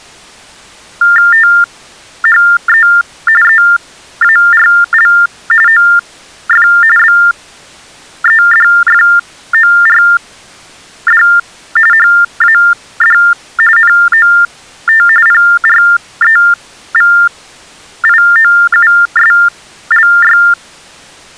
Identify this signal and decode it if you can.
TTY/TDD text telephone tones (45.45 baud Baudot), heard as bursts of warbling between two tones, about 400 Hz shift, 1600 Hz centre. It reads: THE EARL OF BEDFORD HAD NOT PREVIOUSLY